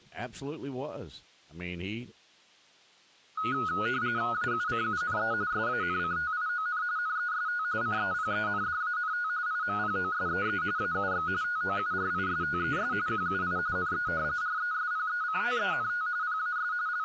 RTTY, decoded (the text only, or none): AUCUNE SANCTION NEST CEPENDANT IMPOSEE AUX TOURISTES QUI NE RESPECTENT PAS …